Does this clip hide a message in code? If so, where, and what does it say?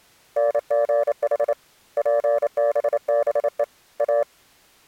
Yes: Morse code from 0.3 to 4.3 s, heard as a keyed tone, hand-sent with a paddle, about 28 wpm, 580 Hz. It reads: NGH PBBE A